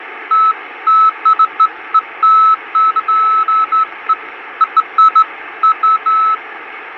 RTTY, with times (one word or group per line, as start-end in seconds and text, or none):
none